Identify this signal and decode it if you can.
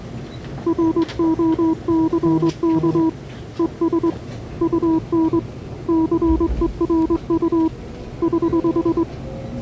Morse code, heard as a keyed tone, hand-sent with a straight key, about 22 wpm, 320 Hz, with the noise inside a subway train. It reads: ROCK ES UN CERU <HH>